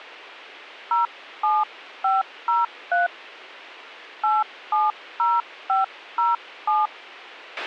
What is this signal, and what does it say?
DTMF, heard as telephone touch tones, dialled by hand, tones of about 160 ms, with a squelch burst at the end. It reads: 07503 870507